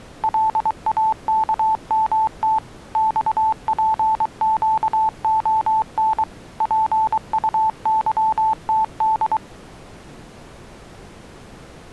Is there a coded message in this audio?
Yes: Morse code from 0.2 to 9.4 s, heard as a keyed tone, machine-sent, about 23 wpm, 880 Hz. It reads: LAKMT XPQON PUYTD